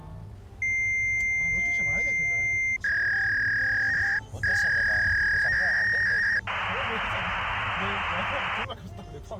Fax machine handshake, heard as a long tone, a warble and hiss, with the noise inside a car.